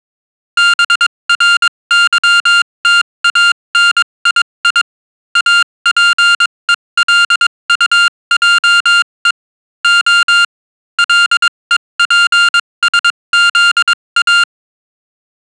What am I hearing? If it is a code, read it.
Morse code, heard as electronic beeps, machine-sent, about 22 wpm, spaced as for 19 wpm, 1400 Hz. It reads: BRYTANII APELUJE O LEPSZA